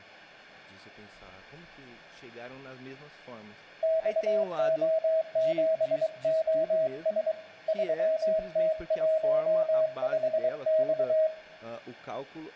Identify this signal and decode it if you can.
Morse code, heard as a keyed tone, hand-sent with a paddle, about 23 wpm, 640 Hz, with room echo and speech in Portuguese. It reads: XO7OS 3T15X